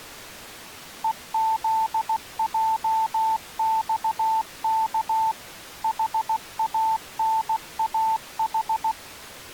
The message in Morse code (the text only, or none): EZJXK HANAH